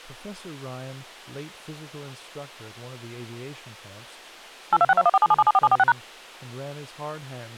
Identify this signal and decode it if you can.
DTMF, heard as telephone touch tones, dialled by machine, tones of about 40 ms, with speech in English. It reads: 82621477774746#